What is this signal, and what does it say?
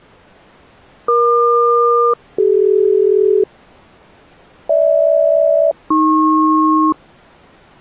Aircraft SELCAL, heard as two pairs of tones. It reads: EQ-CD GH-AP